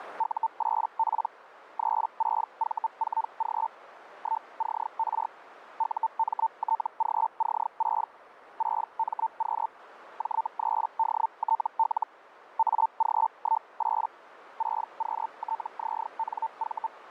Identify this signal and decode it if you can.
Hellschreiber (Feld-Hell, 122.5 baud), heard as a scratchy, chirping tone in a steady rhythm, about 900 Hz, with radio static and a narrow filter. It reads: U8P 36V4G 1CR UMTGC6 6MQ J3DTL AG18 6QTZNV